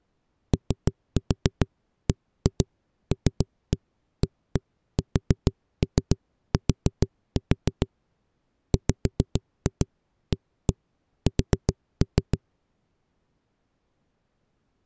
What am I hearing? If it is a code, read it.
Tap code, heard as knocks on a wall, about 7 knocks a second. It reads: OBLAST WAS